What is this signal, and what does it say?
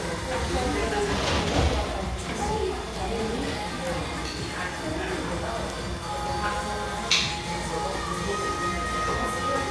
The noise of a cafe. There is no code.